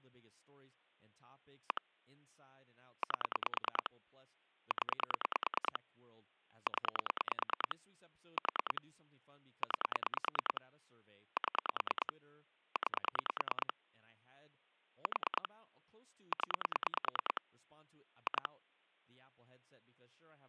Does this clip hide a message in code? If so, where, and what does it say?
Yes: pulse dialling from 1.7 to 18.5 s, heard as clicks on a phone line, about 9 pulses a second, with speech in English. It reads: 1 8 0 0 4 9 7 9 4 0 2